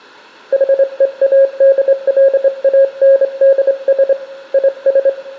Morse code, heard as a keyed tone, hand-sent with a straight key, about 25 wpm, 540 Hz, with room echo. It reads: HEADLANDS IS